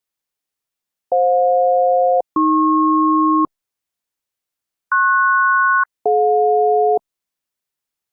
Aircraft SELCAL, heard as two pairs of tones. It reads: FJ-AP PS-DJ